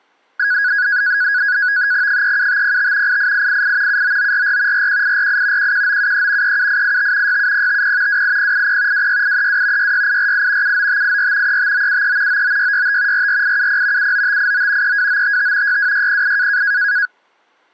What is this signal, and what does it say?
NAVTEX (SITOR-B), 100 baud, 170 Hz shift, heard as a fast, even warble, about 1550 Hz centre. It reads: 37505 88888 79944 41848 11973 37885 67050 28080 26832 66848 79584 35973 99665 44870 79589 32955 62608